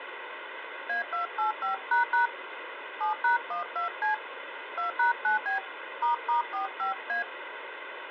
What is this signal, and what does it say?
DTMF, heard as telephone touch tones, dialled by hand, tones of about 120 ms, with phone line noise. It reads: A285## 7#12C 2#9B **45A